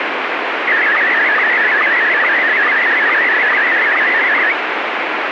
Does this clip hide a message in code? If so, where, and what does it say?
Yes: SSTV (slow-scan television), Scottie S1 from 0.7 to 4.5 s, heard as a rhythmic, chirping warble, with heavy radio static.